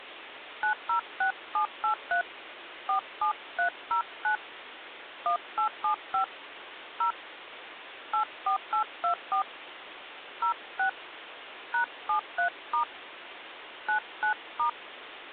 DTMF, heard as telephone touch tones, dialled by hand, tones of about 100 ms, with phone line noise. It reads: 906783 47309 1875 0 84824 06 #73* 99*